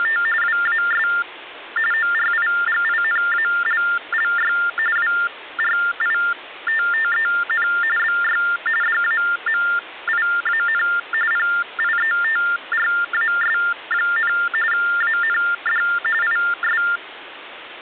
TTY/TDD text telephone tones (45.45 baud Baudot), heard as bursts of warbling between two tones, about 400 Hz shift, 1600 Hz centre, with phone line noise. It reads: … WAS ORIGINALLY WRITTEN BY DAMIAN PIETRAS, AND IS